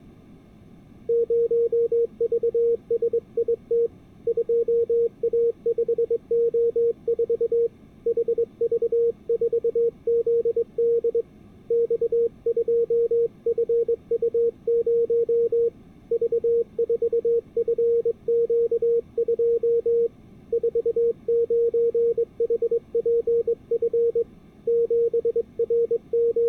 Morse code, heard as a keyed tone, hand-sent with a straight key, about 22 wpm, 470 Hz. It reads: 0VSIT 2A5O4 HV4ZD X2FU0 V4FQ2 49HPF …